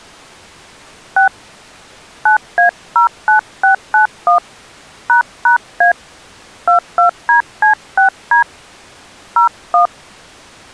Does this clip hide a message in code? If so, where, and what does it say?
Yes: DTMF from 1.2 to 9.9 s, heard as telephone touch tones, dialled by hand, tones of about 110 ms. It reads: 6 9A09691 ##A 22DC6D 01